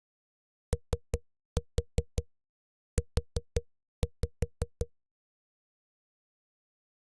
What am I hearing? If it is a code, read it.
Tap code, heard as knocks on a wall, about 5 knocks a second. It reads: OU